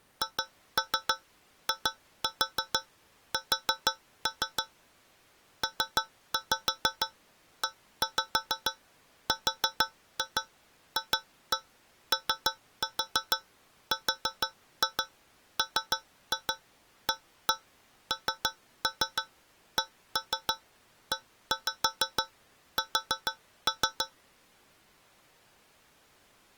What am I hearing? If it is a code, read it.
Tap code, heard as taps on a metal pipe, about 6 knocks a second. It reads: HIS PERFORMANCES